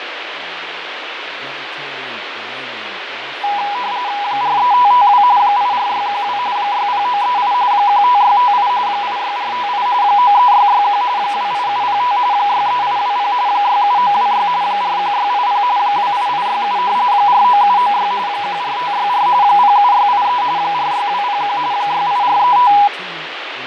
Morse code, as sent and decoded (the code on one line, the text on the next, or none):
none